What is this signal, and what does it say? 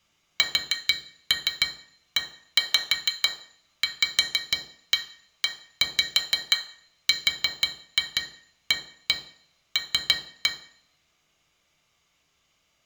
Tap code, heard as taps on glass, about 6 knocks a second, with room echo. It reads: SEVERAL